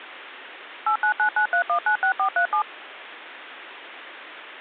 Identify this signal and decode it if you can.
DTMF, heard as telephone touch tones, dialled by machine, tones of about 90 ms. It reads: 89993196437